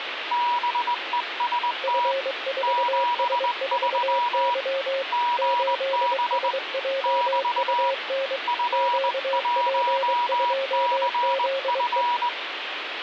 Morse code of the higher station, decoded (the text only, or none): BEST 73 GB <BT> F1CF